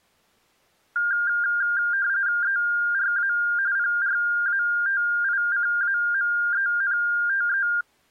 RTTY (45.45 baud, 170 Hz shift), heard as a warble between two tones, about 1500 Hz centre. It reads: ERA PRATICAMENTE